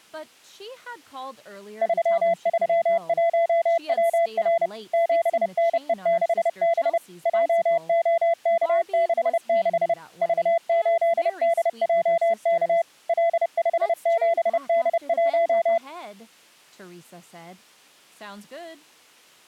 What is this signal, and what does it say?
Morse code, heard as a keyed tone, machine-sent, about 30 wpm, 670 Hz. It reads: 331WR 7NE6B JOK66 V8DJK L57D1